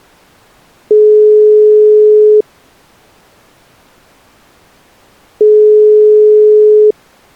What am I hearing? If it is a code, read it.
Telephone call progress tone (single-tone plan, as in most of Europe), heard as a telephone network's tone, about 420 Hz, 1.5 s on and 3 s off. Ringback tone.